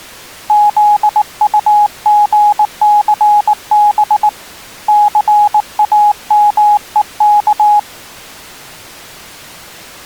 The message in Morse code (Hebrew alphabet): זטגסב סאמוך

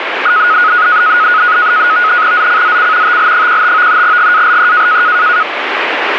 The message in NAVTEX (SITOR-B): ZCZC TL15 GALE

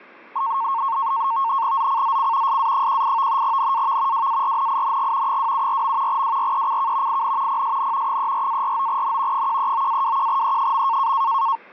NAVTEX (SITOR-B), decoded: ZCZC SA18 NAV WARNING 274. WRECK IN PSN 34-49N 139-21E.

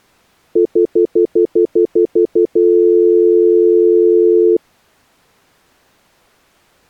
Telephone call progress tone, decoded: stutter dial tone

